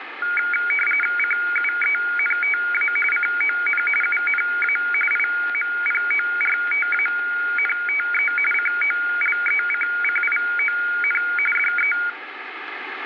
RTTY (45.45 baud, 850 Hz shift), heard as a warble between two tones, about 1850 Hz centre, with radio static. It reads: CUENTA CON UNA IMPORTANTE COLECCION DE